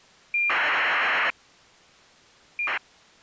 ACARS aircraft data, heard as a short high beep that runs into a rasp, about 2400 baud.